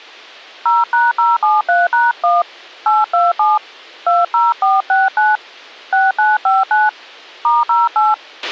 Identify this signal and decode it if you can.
DTMF, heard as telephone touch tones, dialled by hand, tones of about 180 ms, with a squelch burst at the end. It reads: 0#073#1 827 20469 6959 *08